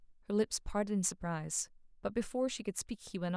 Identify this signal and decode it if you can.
Speech in English. There is no code.